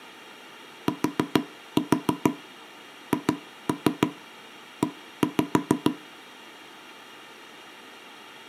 Tap code, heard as knocks on wood, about 6 knocks a second. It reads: THE